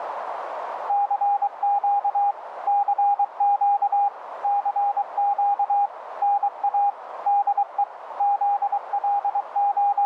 Morse code, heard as a keyed tone, machine-sent, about 23 wpm, 810 Hz, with radio static and a narrow filter. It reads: CQ CQ CQ NA DE …